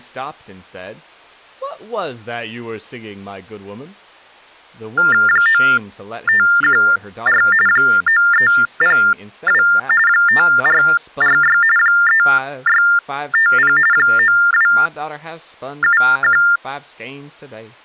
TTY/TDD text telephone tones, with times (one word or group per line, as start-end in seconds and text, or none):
5.3-7.4 9514
7.7-9.6 9302
10.1-11.6 5446
11.8-13.8 3650
13.9-16.4 9271